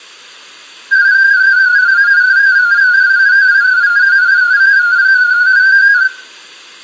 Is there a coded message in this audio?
Yes: multi-tone FSK (Olivia or MFSK type), about 250 Hz wide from 0.9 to 6.1 s, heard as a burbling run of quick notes, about 31.25 baud, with room echo.